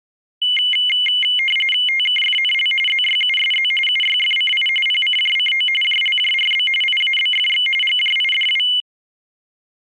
RTTY (45.45 baud, 850 Hz shift), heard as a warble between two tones, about 2550 Hz centre. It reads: TKFNL ZYUSZ UYFCI PCJCO JLJRB IABFX GJIDW